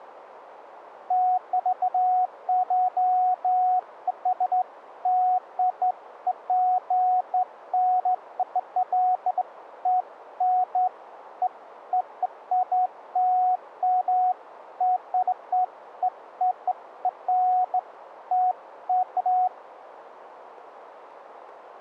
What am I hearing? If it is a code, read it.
Beeps of irregular length, with radio static. There is no code.